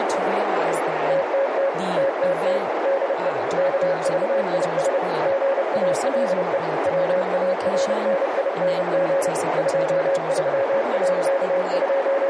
Morse code, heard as a keyed tone, machine-sent, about 30 wpm, 550 Hz, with heavy radio static, a narrow filter and speech in English. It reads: TTT TTT DE KVIS GALE WARNING …